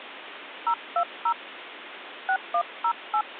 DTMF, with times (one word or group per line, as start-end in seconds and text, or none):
0.7-1.3 020
2.3-3.2 6108